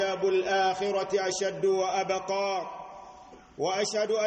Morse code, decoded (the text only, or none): none